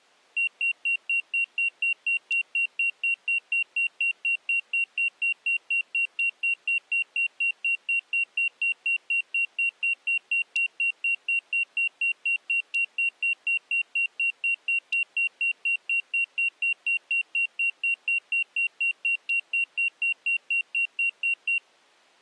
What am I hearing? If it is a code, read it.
Evenly repeated beeps. There is no code.